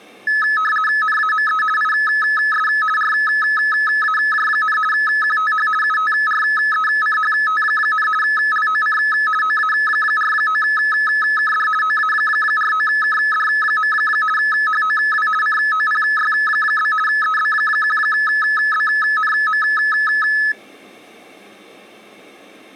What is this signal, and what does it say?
RTTY (50 baud, 450 Hz shift), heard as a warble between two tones, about 1500 Hz centre. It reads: NAME IS RAJ, QTH UTRECHT, LOC OA49KD OA49KD. HOW COPY? EB1BNM